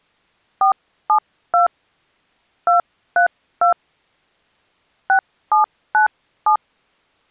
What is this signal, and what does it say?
DTMF, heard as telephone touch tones, dialled by hand, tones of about 100 ms. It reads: 472 232 6797